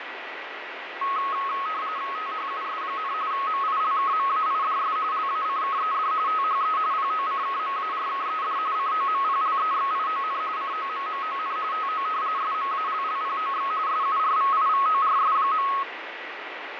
RTTY (45.45 baud, 170 Hz shift), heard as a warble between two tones, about 1180 Hz centre, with radio static and fading. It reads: THUS, MILKMAIDS LACKED THE POCKMARKED COMPLEXION COMMON TO SMALLPOX SURVIVORS.